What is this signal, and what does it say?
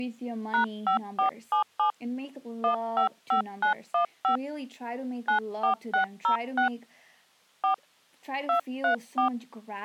DTMF, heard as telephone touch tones, dialled by hand, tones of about 110 ms, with speech in English. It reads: #5477 155915 94606 4 234